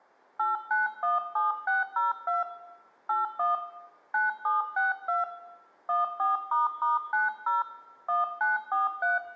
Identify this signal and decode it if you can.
DTMF, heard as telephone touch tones, dialled by hand, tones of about 160 ms, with room echo. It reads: 8917602 81 9762 14**90 1943